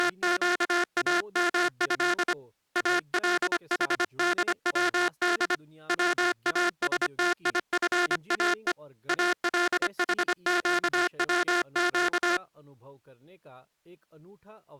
Morse code (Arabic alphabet), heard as a buzzer, hand-sent with a paddle, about 25 wpm, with speech in Hindi. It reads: … الحدود واستيفاء الحقوق